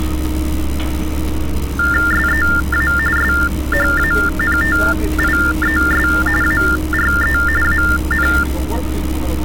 TTY/TDD text telephone tones (45.45 baud Baudot), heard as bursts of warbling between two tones, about 400 Hz shift, 1600 Hz centre, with street noise. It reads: SEA SHANTIES ARE AN